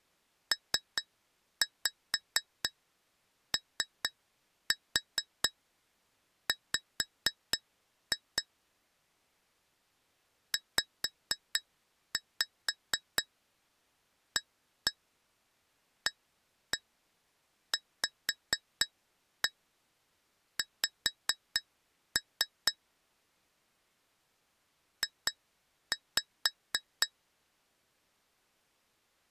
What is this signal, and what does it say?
Tap code, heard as taps on glass, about 4 knocks a second. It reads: POW ZAAVX J